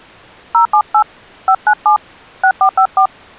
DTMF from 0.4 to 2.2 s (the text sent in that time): 078 597